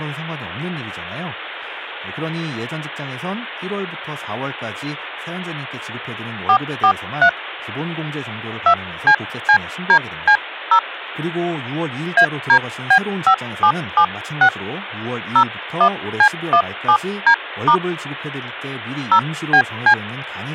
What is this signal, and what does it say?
DTMF, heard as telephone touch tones, dialled by hand, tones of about 80 ms, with speech in Korean. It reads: 443 2CCDC0 ADB5776 01C17D* 0BC